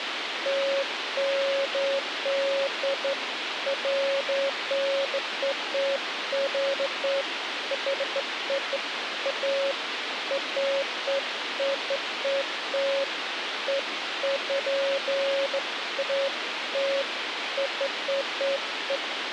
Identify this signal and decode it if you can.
Beeps of irregular length, with radio hiss. There is no code.